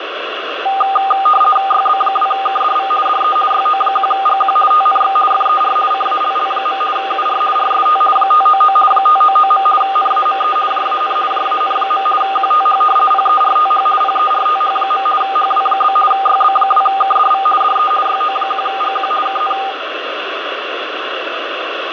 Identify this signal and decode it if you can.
RTTY (50 baud, 450 Hz shift), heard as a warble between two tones, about 1000 Hz centre, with radio static. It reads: YB2KDV DE YO1GQ TNX FER CALL. UR RST 599 599. NAME JAN JAN. QTH PERTH PERTH. HW? YB2KDV DE YO1GQ KN